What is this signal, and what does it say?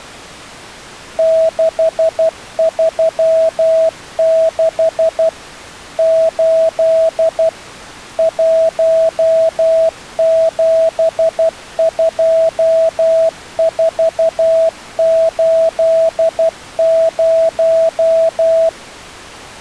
Morse code, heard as a keyed tone, machine-sent, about 12 wpm, 650 Hz. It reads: 636 8 172480